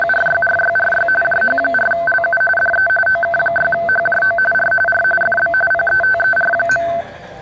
RTTY (45.45 baud, 850 Hz shift), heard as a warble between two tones, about 1100 Hz centre, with the noise of a restaurant. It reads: … JH4LU DE OK6HJO R R FB PETER.